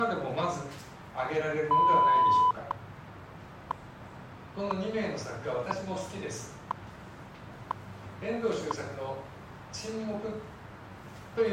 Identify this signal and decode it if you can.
Radio time signal (WWV, Colorado), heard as ticks, one a second.